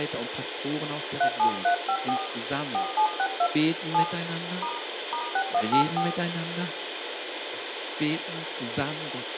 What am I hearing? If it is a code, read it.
DTMF, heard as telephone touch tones, dialled by hand, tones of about 80 ms, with phone line noise, room echo and speech in German. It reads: 37354 4762 7 * *6184